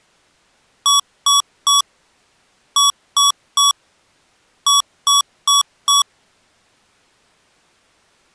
Beep code, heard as beeps from a small speaker, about 1130 Hz. 3-3-4. In Phoenix BIOS tables: video failure.